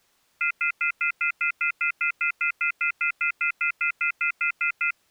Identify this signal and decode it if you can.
Telephone call progress tone (North American plan), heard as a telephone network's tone, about 1400, 2050, 2450, 2600 Hz, 0.1 s on and 0.1 s off. Off-hook warning tone.